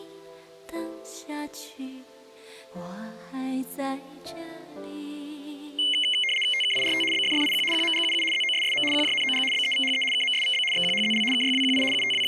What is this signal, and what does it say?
RTTY (75 baud, 850 Hz shift), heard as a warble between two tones, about 2550 Hz centre. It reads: TKIRT BFFIQ QMGUU ZOSSM QJNOG BEVHE KMSVB XQHZL KYWQI …